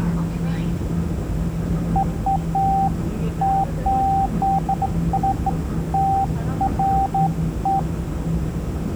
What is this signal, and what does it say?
Beeps of irregular length, with room echo and the noise inside a subway train. There is no code.